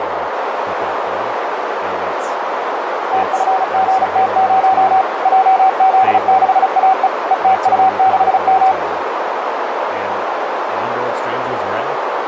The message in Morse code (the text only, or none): TFGT0 JZ6AE ETU6M